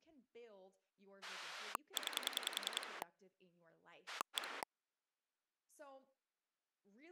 Pulse dialling, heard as a rotary dial, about 10 pulses a second, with speech in English. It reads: 9 1